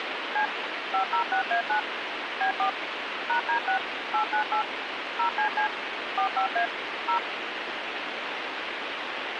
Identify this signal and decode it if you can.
DTMF, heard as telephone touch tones, dialled by machine, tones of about 100 ms, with radio hiss. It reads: C 506A9 B4 #D6 898 0CC 45A 0